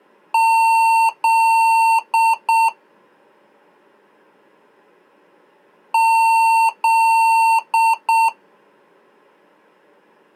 Beep code, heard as beeps from a small speaker, played twice, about 900 Hz. 2 long, 2 short.